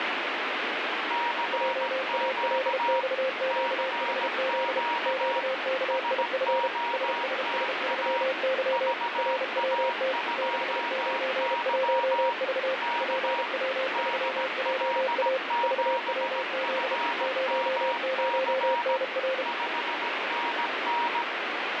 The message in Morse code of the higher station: CQ CQ SOTA VA2Y K DL7FMC 5NN

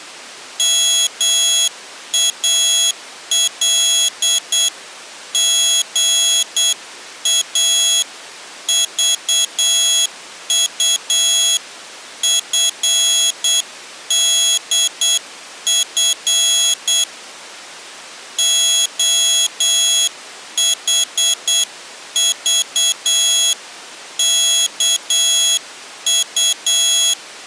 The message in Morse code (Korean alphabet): 목소리는 풀이

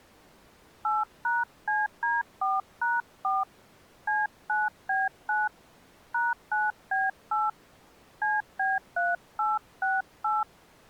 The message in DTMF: 8#CD4#4 C9B9 #9B8 CB3868

